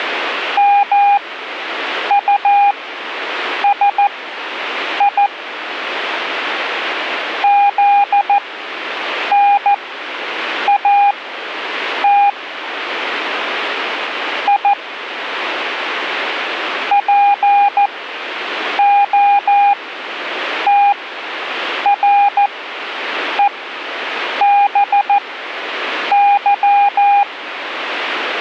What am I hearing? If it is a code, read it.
Morse code, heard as a keyed tone, machine-sent, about 14 wpm, spaced as for 7 wpm, 810 Hz. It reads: MUSI ZNAT I POTREBY